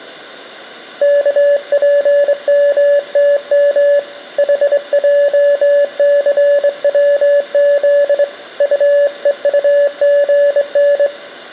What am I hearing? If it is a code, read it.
Morse code, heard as a keyed tone, hand-sent with a straight key, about 23 wpm, 570 Hz, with room echo. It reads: KPMTM HJCWZ UEUGN